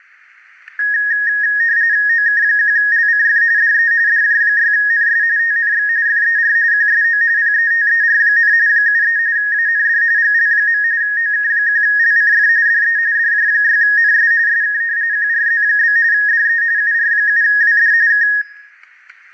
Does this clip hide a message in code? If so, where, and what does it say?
Yes: RTTY (45.45 baud, 170 Hz shift) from 0.8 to 18.4 s, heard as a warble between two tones, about 1750 Hz centre, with static crashes and room echo. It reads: OK1LCF DE DJ6NS TNX FER QSO PETER, 73 AND GL. OK1LCF DE DJ6NS SK QRZ? DE UR7WD K